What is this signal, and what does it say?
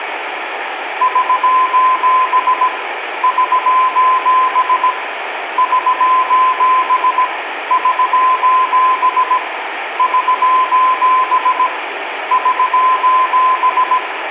Morse code, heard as a keyed tone, hand-sent with a paddle, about 17 wpm, 1020 Hz, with radio static and room echo. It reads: <SOS> <SOS> <SOS> <SOS> <SOS> <SOS>